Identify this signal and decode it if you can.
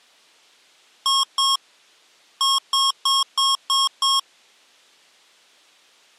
Beep code, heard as beeps from a small speaker, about 1090 Hz. 2-6.